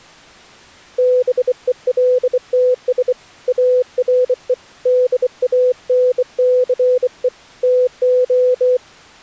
Morse code, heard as a keyed tone, hand-sent with a bug key, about 24 wpm, 500 Hz. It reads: BELTS ARE DANCE TO